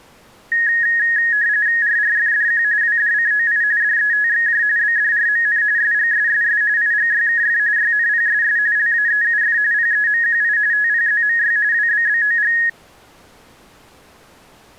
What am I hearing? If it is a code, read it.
RTTY (45.45 baud, 170 Hz shift), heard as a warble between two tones, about 1750 Hz centre. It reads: RRFDQ WDCOI DETXJ BDRMN SGSSS IGYKF YNPSS LAEUF PEMQI TPZMY WBBOG